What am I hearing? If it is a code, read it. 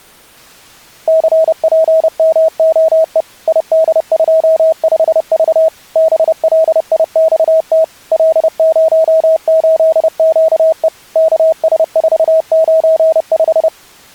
Morse code, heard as a keyed tone, machine-sent, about 30 wpm, 640 Hz. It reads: CPMOE ID25V BLIXT L08QE KS495